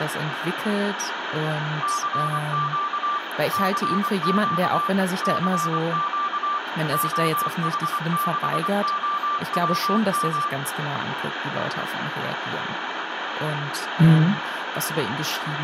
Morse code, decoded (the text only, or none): CQ CQ CQ OH6OWM